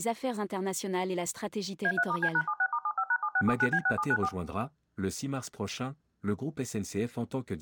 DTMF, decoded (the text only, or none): A3*C#76*75#7679B6794